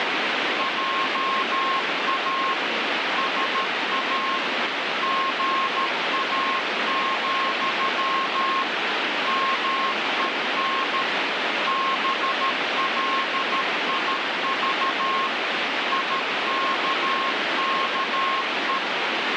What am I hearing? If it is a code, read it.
Morse code, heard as a keyed tone, machine-sent, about 13 wpm, 1070 Hz, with heavy radio static. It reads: JA SA GA, MEN BLIV IKKE